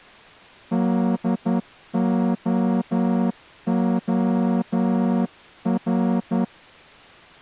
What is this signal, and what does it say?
Morse code, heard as a horn, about 10 wpm. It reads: DOOR